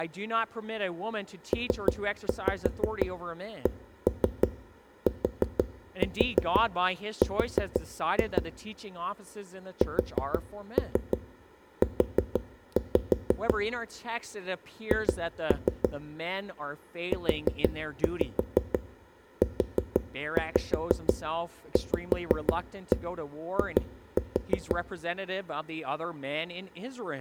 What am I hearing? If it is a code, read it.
Tap code, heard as knocks on a wall, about 6 knocks a second, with room echo and speech in English. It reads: PCTR SU H UUVI